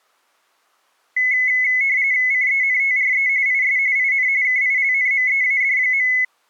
RTTY (45.45 baud, 170 Hz shift), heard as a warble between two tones, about 2100 Hz centre. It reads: CENTRE IS IN KILNMEAD.